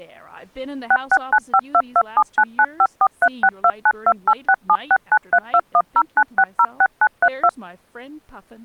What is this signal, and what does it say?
DTMF, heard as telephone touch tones, dialled by machine, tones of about 60 ms, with speech in English. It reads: 66952279954362928676932109606932